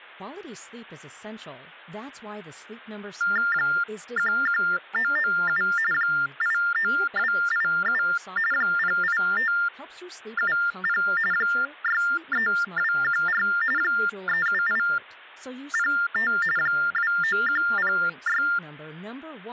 TTY/TDD text telephone tones (45.45 baud Baudot), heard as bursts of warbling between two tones, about 400 Hz shift, 1600 Hz centre, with hum and speech in English. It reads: 11997 89287 08570 63214 37805 29106